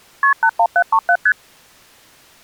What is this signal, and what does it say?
Multi-frequency trunk signalling (R1, as on North American trunks), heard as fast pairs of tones, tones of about 70 ms. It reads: KP 81737 ST